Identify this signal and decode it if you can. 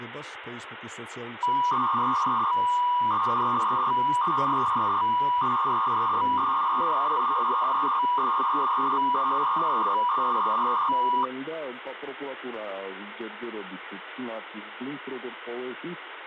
300-baud modem data (V.21 tones), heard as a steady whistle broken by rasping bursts, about 300 baud, 200 Hz shift, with phone line noise.